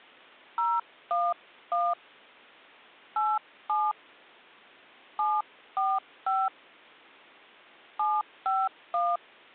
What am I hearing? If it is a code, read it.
DTMF, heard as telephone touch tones, dialled by hand, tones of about 220 ms. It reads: 011 87 745 751